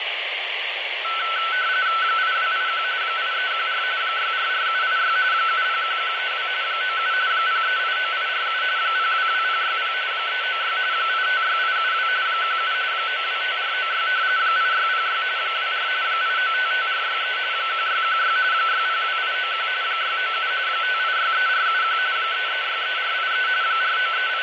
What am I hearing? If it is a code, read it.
RTTY (45.45 baud, 170 Hz shift), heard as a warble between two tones, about 1420 Hz centre, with radio static, fading and room echo. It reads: 8281 8314 644786 701132 97 0389847 022060 396 856872 17 925496 8606 24 8955463 1616 602891 697 5863471 3363483 …